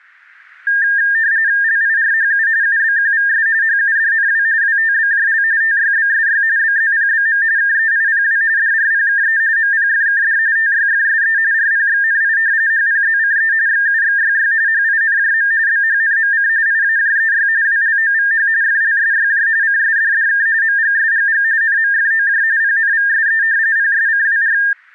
RTTY (45.45 baud, 170 Hz shift), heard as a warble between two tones, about 1700 Hz centre. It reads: LIRHU UBQVS HUDNW WTBJL TYBSY BZPBM KEIPW DRPKE MPFKD TYFSE RPXNI HPZCE XUXYY HINJM BHNMC IAJEY WLOVH FLSYJ CSDDK MGSGG NMFOJ PNVSE PSCWR